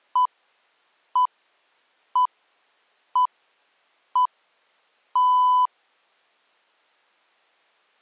Radio time signal (six pips, as the Greenwich Time Signal), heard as pips.